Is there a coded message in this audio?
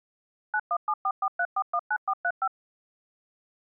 Yes: DTMF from 0.5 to 2.5 s, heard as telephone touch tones, dialled by machine, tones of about 60 ms. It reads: 917443419435